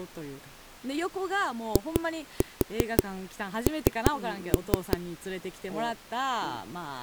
Tap code, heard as knocks on a wall, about 5 knocks a second, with speech in Japanese. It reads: IN